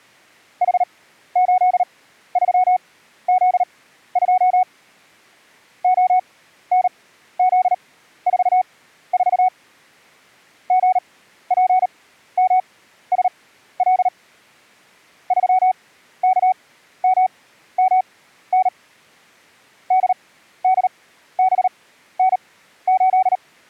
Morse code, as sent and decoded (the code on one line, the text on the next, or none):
.... ---.. ...-- --.. ..--- / --- -. --.. ....- ....- / --. .--. -- ... .-.. / ...-- -.- -- -- -. / -.. -.. -... -. ---..
H83Z2 ONZ44 GPMSL 3KMMN DDBN8